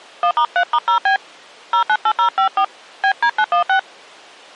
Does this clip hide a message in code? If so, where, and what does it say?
Yes: DTMF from 0.2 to 3.8 s, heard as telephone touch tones, dialled by hand, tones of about 80 ms. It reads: 1*3*0B 098054 BD916